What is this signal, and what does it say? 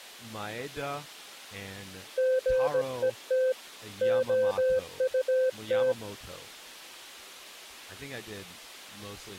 Morse code, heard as a keyed tone, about 17 wpm, 520 Hz, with speech in English. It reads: GET OUT